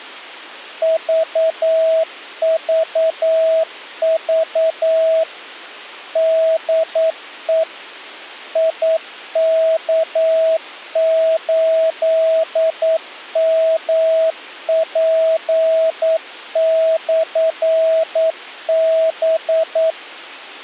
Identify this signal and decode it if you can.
Morse code, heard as a keyed tone, machine-sent, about 9 wpm, 650 Hz. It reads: VVV DE IK8MP/B